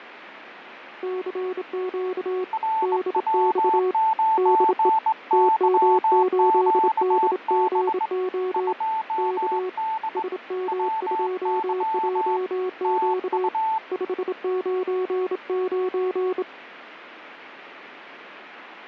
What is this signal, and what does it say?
Morse code, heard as two keyed tones, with radio static. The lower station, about 27 wpm, 370 Hz: CQ DX DE TM8DGO K SM2JQ 599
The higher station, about 21 wpm, 880 Hz: RW9YQB 2D WY TU